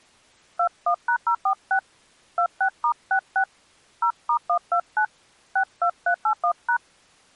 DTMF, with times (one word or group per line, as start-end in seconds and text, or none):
0.6-1.8 21#046
2.4-3.4 26*66
4.0-5.1 0*129
5.6-6.8 62381#